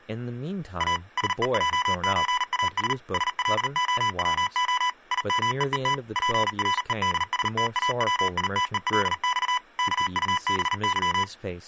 Morse code (Russian alphabet), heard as electronic beeps, machine-sent, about 39 wpm, 1000 Hz, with speech in English. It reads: А СЕЙЧАС СЛОВО ИМЕЕТ ПРЕДСТАВИТЕЛЬ КУБЫ